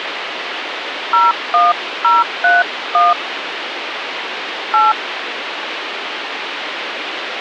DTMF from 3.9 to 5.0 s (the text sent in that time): 8